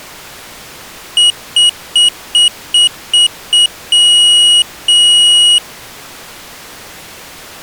Beep code, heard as a piezo beeper, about 2900 Hz. 7 short, 2 long.